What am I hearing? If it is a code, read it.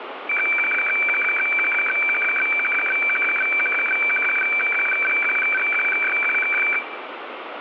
Weather fax (radiofax), 120 lines a minute, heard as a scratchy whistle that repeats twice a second, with radio static.